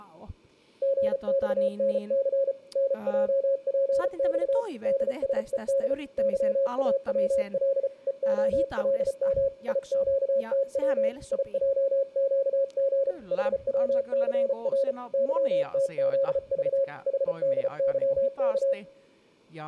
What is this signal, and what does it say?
Morse code, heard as a keyed tone, hand-sent with a paddle, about 34 wpm, 550 Hz, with speech in Finnish. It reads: GXNC NJPX DSED YAWL EOLM IQTW IJQG HWCR YTZV HDYK